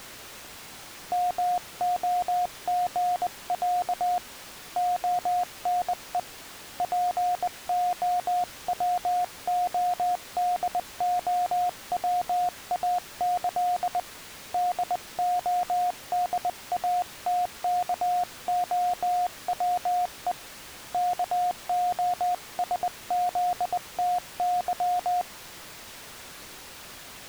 Morse code (with Polish letters), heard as a keyed tone, hand-sent with a bug key, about 20 wpm, 720 Hz. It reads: MOGĄ ONE POWODOWAĆ DODATKOWE KOSZTY